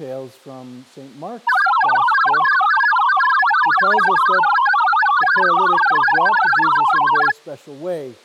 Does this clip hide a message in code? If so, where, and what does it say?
Yes: multi-tone FSK (Olivia or MFSK type), about 1000 Hz wide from 1.5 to 7.3 s, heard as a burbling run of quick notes, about 62.5 baud.